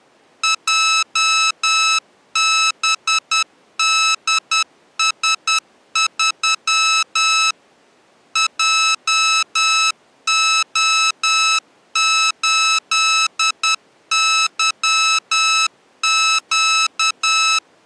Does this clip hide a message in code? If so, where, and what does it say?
Yes: Morse code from 0.4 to 17.6 s, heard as electronic beeps, machine-sent, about 10 wpm, 1300 Hz. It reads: JBDS3 JO8YQ